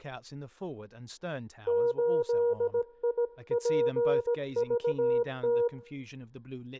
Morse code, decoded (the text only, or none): 8IPVT